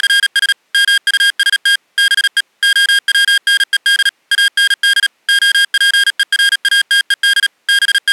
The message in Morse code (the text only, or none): … MUST BE OWNED AND OPERATED …